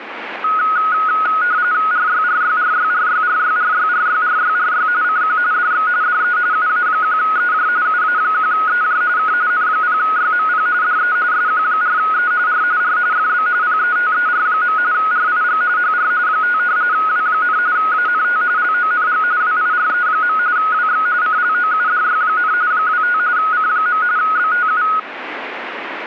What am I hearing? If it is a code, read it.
RTTY (45.45 baud, 170 Hz shift), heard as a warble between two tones, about 1360 Hz centre, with radio static. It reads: RYRYRYRYRYRYRYRYRY CQ DX DE UA1EJ UA1EJ K N0YMP DE SQ4E R R FB PETER. RIG HR 5 W, ANT LONG WIRE. WX CLOUDY, 25 C. BTU